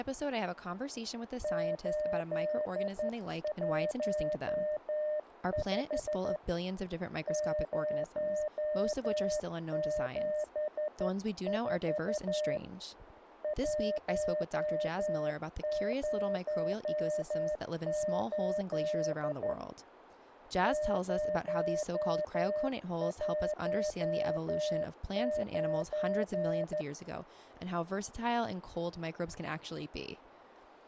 Morse code, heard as a keyed tone, hand-sent with a straight key, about 12 wpm, 610 Hz, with speech in English. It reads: 815 074 108 019